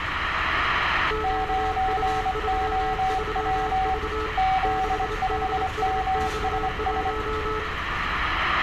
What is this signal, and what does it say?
Morse code, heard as two keyed tones, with radio static, room echo and street noise. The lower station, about 27 wpm, 430 Hz: QU33V 6DSX1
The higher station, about 24 wpm, 760 Hz: 9OW Z5MSS